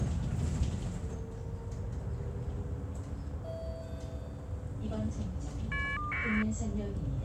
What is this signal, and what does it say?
Caller ID data burst, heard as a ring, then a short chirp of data, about 1200 baud, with the noise inside a bus.